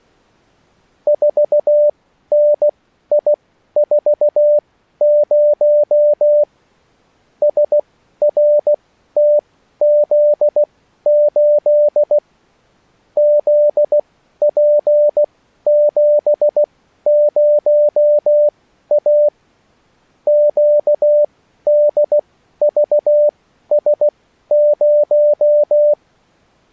Morse code, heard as a keyed tone, machine-sent, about 16 wpm, spaced as for 12 wpm, 590 Hz. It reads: 4NI40 SRTZ8 ZP70A QDVS0